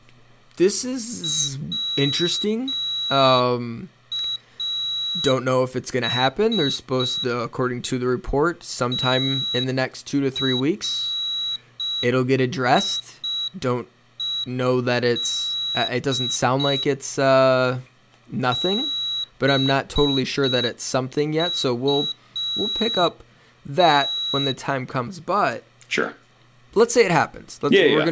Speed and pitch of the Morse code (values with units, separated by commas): 5 wpm, 3900 Hz